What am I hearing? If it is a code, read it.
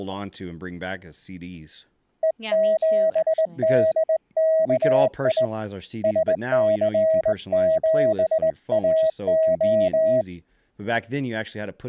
Morse code, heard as a keyed tone, hand-sent with a straight key, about 19 wpm, 640 Hz, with speech in English. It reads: E7DKI SC7AO